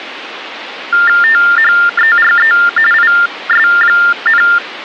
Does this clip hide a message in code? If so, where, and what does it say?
Yes: TTY/TDD text telephone tones (45.45 baud Baudot) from 0.9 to 4.6 s, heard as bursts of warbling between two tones, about 400 Hz shift, 1600 Hz centre, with phone line noise. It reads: THERE IS,